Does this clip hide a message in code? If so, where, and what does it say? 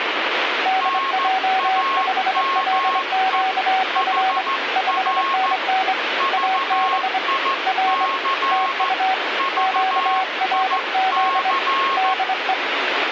Yes: Morse code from 0.6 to 12.6 s, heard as two keyed tones, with radio static. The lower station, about 24 wpm, 760 Hz: DJ5LQF 5NN AB R TU QRZ DE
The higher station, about 14 wpm, 1080 Hz: NAME HR VIC VIC